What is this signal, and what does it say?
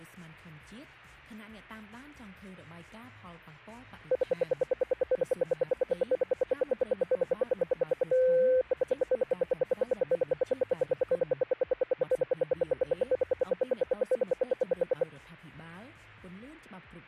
Radio time signal (RWM, Moscow), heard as ten pulses a second.